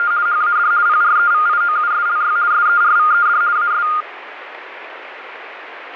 RTTY (50 baud, 170 Hz shift), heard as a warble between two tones, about 1320 Hz centre, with radio static. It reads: … HAD PREVIOUSLY SERVED AS